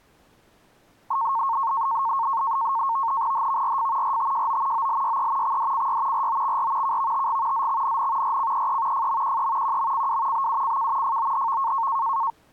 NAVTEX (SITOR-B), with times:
3.3-4.2 HVRF
4.0-4.9 RTJO
4.7-5.6 OLYE
5.4-6.3 XDCY
6.1-7.0 ROXR
6.8-7.7 KVTG
7.5-8.4 ZXNN
8.2-9.1 RCEE
8.9-9.8 FMQE
9.6-10.5 QMCW
10.3-11.2 BUCK
11.0-11.9 FOHV

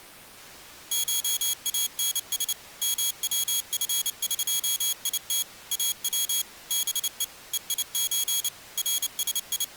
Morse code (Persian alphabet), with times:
0.9-2.5 شانس
2.8-5.4 موفقیت
5.7-6.4 او
6.7-7.2 به
7.5-8.5 هیچ
8.8-9.8 …

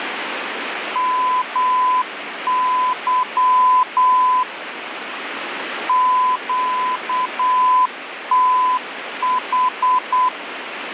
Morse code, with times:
1.0-4.4 MY
5.9-10.3 QTH

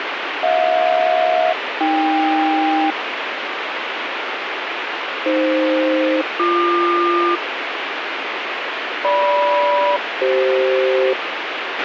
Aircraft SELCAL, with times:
0.4-2.9 HJ-AK
5.3-7.4 AF-BQ
9.0-11.1 GM-CF

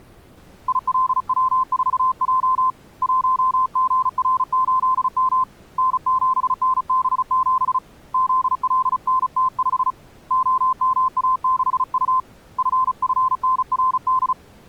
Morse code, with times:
0.7-2.7 ILW4J
3.0-5.4 1GR8M
5.8-7.8 N7NB7
8.1-9.9 ZLNT5
10.3-12.2 OMA6U
12.6-14.3 FFNRD

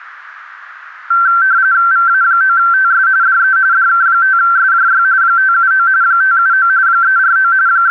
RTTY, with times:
1.9-3.1 VA9TS
3.2-3.6 DE
3.7-5.0 DK5SJY
5.2-5.9 579
6.0-6.7 579
6.9-7.5 349
7.7-7.9 …

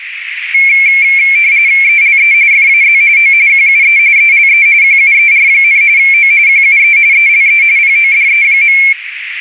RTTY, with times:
1.8-2.3 ELE
2.5-3.0 FAZ
3.2-3.3 O
3.5-4.0 QUE
4.2-4.7 ELE
4.8-5.8 QUER,
6.0-6.3 O
6.5-7.0 QUE
7.1-7.6 ELE
7.8-8.8 PODE.

